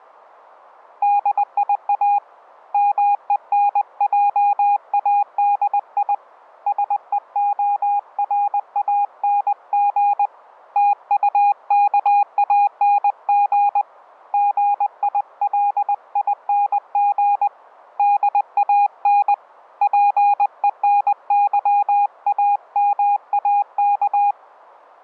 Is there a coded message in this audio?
Yes: Morse code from 1.0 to 24.4 s, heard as a keyed tone, hand-sent with a paddle, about 20 wpm, 820 Hz. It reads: DIA MENJADI SEORANG TUKANG GILING DAN PENYAMAK